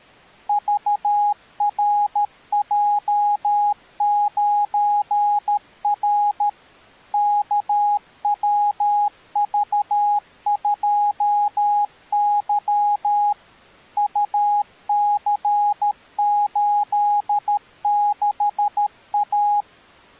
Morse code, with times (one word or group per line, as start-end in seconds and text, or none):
0.5-6.5 VRJ9R
7.1-13.3 KWV2Y
14.0-19.6 UC86A